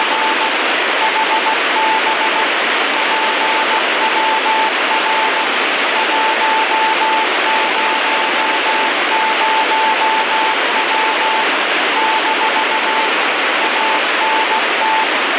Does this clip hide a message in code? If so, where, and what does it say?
Yes: Morse code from 0.0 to 15.1 s, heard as a keyed tone, machine-sent, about 16 wpm, 880 Hz, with heavy radio static. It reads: … HB PWR 100W - ANT